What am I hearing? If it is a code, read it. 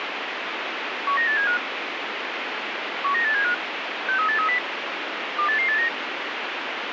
Five-tone selective call (CCIR), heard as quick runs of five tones, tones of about 100 ms, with radio hiss. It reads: 19875 19875 63830 28889